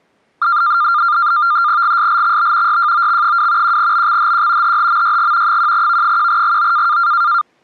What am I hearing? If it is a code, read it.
NAVTEX (SITOR-B), 100 baud, 170 Hz shift, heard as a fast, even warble, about 1300 Hz centre. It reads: GSLXB YJOX2 1BXHQ HHMYG 1V1GO